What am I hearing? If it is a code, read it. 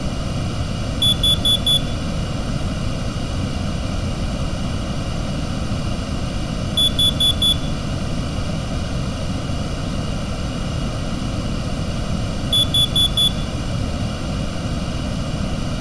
Alarm pattern, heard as an alarm's beeps, played three times, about 3450 Hz, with room echo. Temporal four. Carbon monoxide.